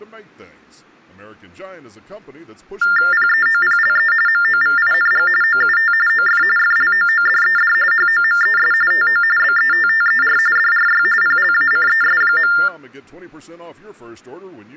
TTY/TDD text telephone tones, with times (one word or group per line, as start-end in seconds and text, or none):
3.1-4.1 PEOPLE
4.3-5.3 MOVING
5.4-5.9 OUT
6.1-6.4 OF
6.6-7.7 FLOODED
7.9-8.7 HOMES
8.9-9.2 TO
9.4-10.4 BETTER
10.6-11.0 DRY
11.2-12.5 PLACES.